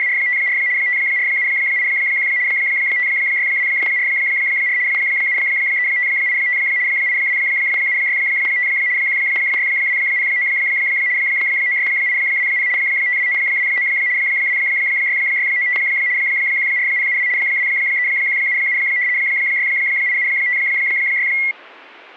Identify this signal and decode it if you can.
RTTY (75 baud, 170 Hz shift), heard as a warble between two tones, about 2050 Hz centre, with static crashes. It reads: … 54781 56244 73585 82765 16209 96820 52929 26695 14072 23177 68756